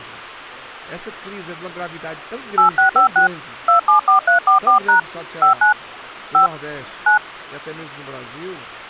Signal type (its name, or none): DTMF